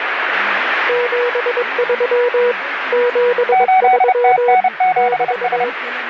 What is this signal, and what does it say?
Morse code, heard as two keyed tones, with radio static and speech in Marathi. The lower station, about 22 wpm, 490 Hz: 73 73 <BT>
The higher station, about 30 wpm, 740 Hz: 8TN7S